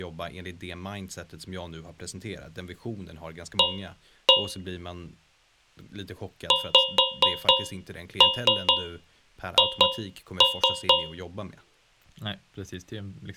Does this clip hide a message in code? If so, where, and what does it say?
Yes: tap code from 3.6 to 11.3 s, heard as taps on a metal pipe, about 4 knocks a second, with speech in Swedish. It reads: A XH